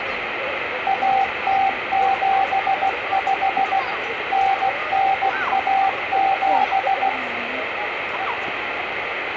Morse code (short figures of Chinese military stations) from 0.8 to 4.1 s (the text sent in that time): 1075